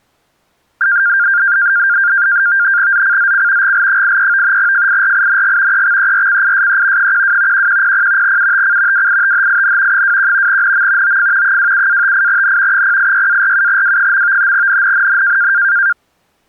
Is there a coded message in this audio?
Yes: NAVTEX (SITOR-B), 100 baud, 170 Hz shift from 0.8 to 15.9 s, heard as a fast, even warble, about 1500 Hz centre. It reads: ZCZC GL83 FIRING EXERCISE 12 1100 UTC WITHIN 21 NM OF 27-58N 086-47W. NNNN